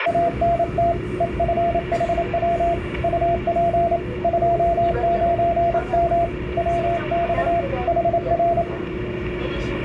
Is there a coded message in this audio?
Yes: Morse code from 0.0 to 8.7 s, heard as a keyed tone, hand-sent with a paddle, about 28 wpm, 680 Hz, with the noise inside a subway train. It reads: ANT EFHW UP 29M WX HR